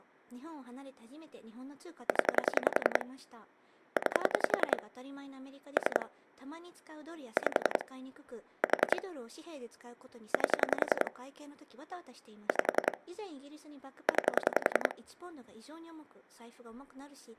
Pulse dialling, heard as clicks on a phone line, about 10 pulses a second, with speech in Japanese. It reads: 0 9 3 5 4 8 5 9